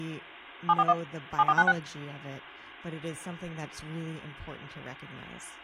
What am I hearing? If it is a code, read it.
DTMF, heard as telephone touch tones, dialled by machine, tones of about 50 ms, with speech in English. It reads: 741 7496